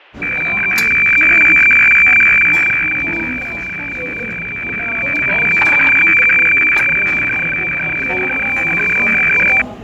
Weather fax (radiofax), 120 lines a minute, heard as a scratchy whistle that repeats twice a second, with radio static, fading, static crashes and the noise of a restaurant.